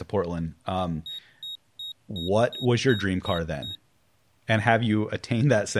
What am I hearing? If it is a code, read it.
Beep code, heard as a piezo beeper, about 3750 Hz, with speech in English. 8 short. In AMI BIOS tables: display memory failure; in Dell tables: LCD failure.